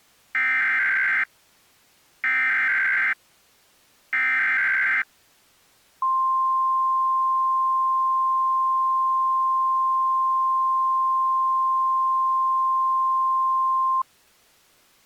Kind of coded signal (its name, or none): Emergency Alert System (SAME) tones